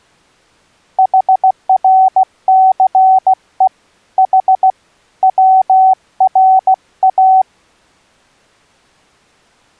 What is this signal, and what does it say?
Morse code (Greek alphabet), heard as a keyed tone, hand-sent with a paddle, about 16 wpm, 760 Hz. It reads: ΗΡΘΕ Η ΩΡΑ